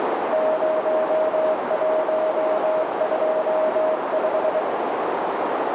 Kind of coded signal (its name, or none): Morse code